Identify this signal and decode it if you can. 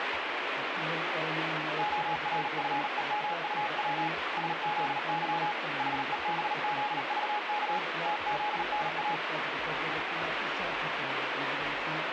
Morse code, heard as a keyed tone, hand-sent with a paddle, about 38 wpm, 840 Hz, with radio static. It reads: ORFEMUW SZY HEBZVK TZNA